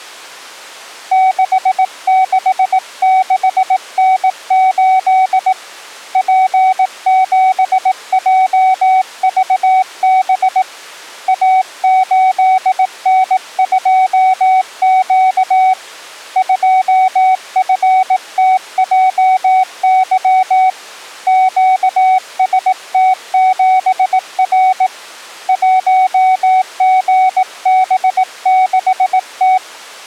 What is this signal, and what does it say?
Morse code, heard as a keyed tone, hand-sent with a bug key, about 18 wpm, 750 Hz. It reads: 666N8 P7JVB A8N2Q 2FTJY QST7R 1GB6T